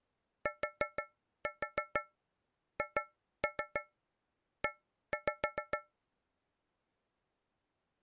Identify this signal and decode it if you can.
Tap code, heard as taps on a metal pipe, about 6 knocks a second. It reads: THE